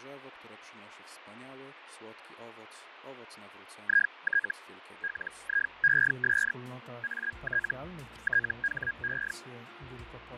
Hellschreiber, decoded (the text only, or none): IT LIES AT THE